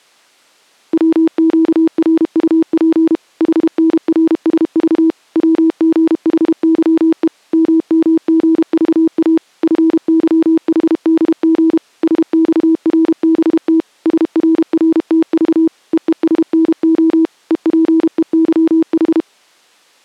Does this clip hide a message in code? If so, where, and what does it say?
Yes: Morse code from 0.9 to 19.3 s, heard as a keyed tone, machine-sent, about 32 wpm, 320 Hz. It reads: WQRUP HNRSV WGHYE MMGVA FYHDG SXRBT SRRTV EESNO EPEYH